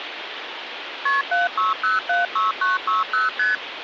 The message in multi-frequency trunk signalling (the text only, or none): KP 76076960 ST